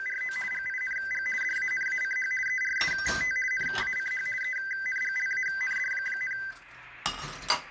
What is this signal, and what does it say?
RTTY (50 baud, 450 Hz shift), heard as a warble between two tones, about 1800 Hz centre, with kitchen noise. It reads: … GING DANACH ERST NACH ENGLAND,